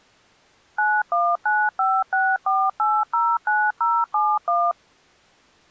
DTMF, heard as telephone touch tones, dialled by machine, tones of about 240 ms. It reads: 919564809071